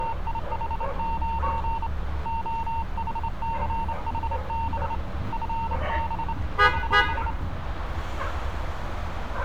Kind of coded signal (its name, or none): Morse code